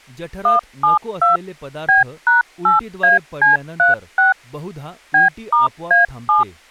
DTMF, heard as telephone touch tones, dialled by machine, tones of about 140 ms, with speech in Marathi. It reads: 172 B#8AC36 B*A7